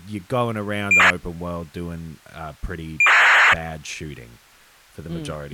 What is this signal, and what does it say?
ACARS aircraft data, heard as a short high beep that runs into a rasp, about 2400 baud, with speech in English.